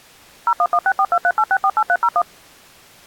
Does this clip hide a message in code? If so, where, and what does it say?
Yes: DTMF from 0.5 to 2.2 s, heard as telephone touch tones, dialled by machine, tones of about 60 ms. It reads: 01164238648301